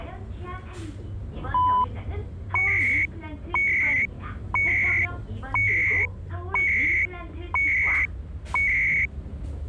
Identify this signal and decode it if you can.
Radio time signal (CHU, Canada), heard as beeps and data bursts, one a second, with the noise inside a bus.